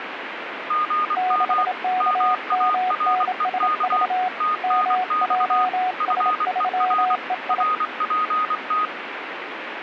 Morse code, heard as two keyed tones, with radio static. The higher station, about 24 wpm, 1240 Hz: GM MAREK TNX FER RPT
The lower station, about 27 wpm, 740 Hz: 6KMNSV MJS3EI